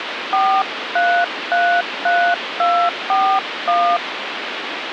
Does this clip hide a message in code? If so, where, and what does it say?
Yes: DTMF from 0.3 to 4.0 s, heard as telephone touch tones, dialled by hand, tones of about 290 ms, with phone line noise. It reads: 4333241